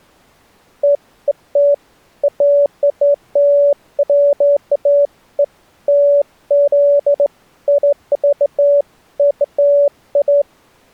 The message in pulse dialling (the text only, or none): none